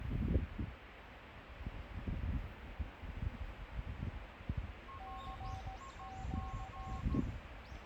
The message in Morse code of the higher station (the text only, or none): RIG